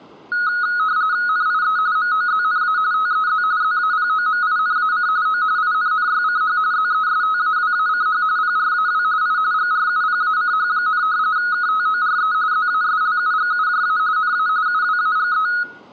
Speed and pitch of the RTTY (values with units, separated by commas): 45.45 baud, 170 Hz shift, 1360 Hz centre